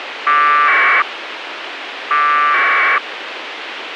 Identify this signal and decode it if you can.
Packet radio (AX.25, as in APRS), 1200 baud, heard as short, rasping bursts, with radio hiss.